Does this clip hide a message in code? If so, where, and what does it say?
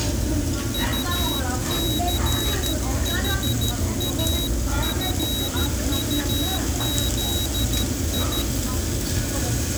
Yes: Morse code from 0.7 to 8.5 s, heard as a high beeper, hand-sent with a paddle, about 13 wpm, 3850 Hz, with the noise of a restaurant. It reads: UCHAFUZI